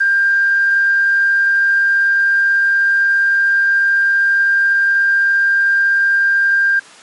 A steady tone. There is no code.